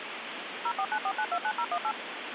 DTMF, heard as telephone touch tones, dialled by machine, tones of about 60 ms, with phone line noise. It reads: 0494929018